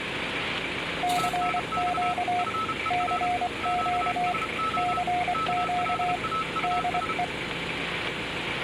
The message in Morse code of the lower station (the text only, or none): CQ CQ CQ DE